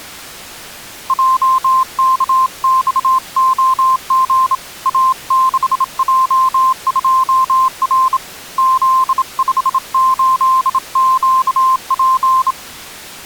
Morse code, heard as a keyed tone, hand-sent with a bug key, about 27 wpm, 1050 Hz. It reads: JKXOG A6J2R Z58QP